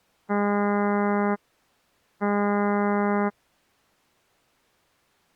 Ship horn signal, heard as a ship's horn, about 200 Hz. 2 short. At sea: I am altering course to port.